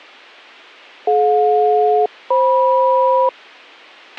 Aircraft SELCAL, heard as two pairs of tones, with a squelch burst at the end. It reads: DJ-FM